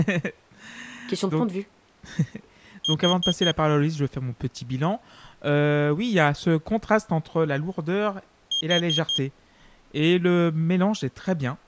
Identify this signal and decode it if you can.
Alarm pattern, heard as an alarm's beeps, played twice, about 3200 Hz, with speech in French. Temporal four. Carbon monoxide.